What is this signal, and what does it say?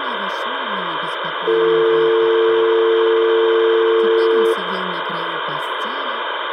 Telephone call progress tone (North American or UK plan), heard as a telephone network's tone, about 350, 450 Hz, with phone line noise. Dial tone.